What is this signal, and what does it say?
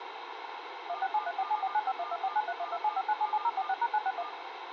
DTMF, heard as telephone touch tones, dialled by machine, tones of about 50 ms, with radio hiss. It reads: 167347495124931275977046#961